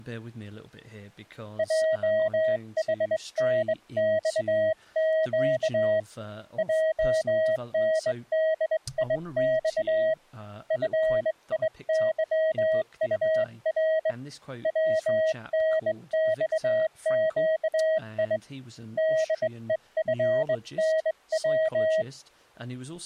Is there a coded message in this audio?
Yes: Morse code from 1.5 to 22.1 s, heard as a keyed tone, hand-sent with a straight key, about 21 wpm, 640 Hz, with speech in English. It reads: JHNXQ JNDIX FIYUR WNXQI DEFNW